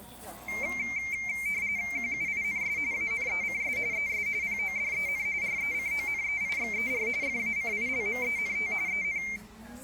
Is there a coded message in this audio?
Yes: RTTY (45.45 baud, 170 Hz shift) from 0.5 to 9.4 s, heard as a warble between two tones, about 2200 Hz centre, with the noise of a restaurant. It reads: QUINS ANECS ES PODEN RECONEIXER FACILMENT EN